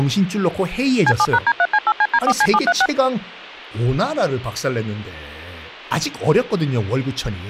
DTMF, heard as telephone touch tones, dialled by machine, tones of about 50 ms, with speech in Korean. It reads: C7#D3C8CD4C736